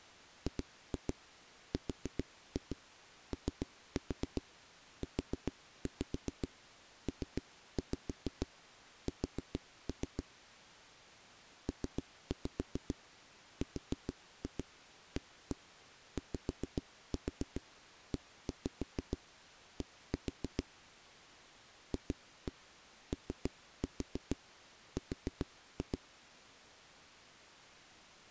Tap code, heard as knocks on a wall, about 7 knocks a second. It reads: GROUPS PRAYED FOR